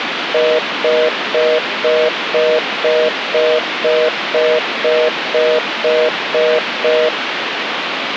Telephone call progress tone (North American plan), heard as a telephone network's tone, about 480, 620 Hz, 0.25 s on and 0.25 s off, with phone line noise. Congestion tone.